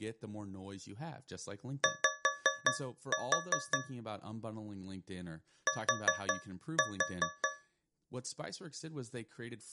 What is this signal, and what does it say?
Tap code, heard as taps on a metal pipe, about 5 knocks a second, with speech in English. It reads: Y T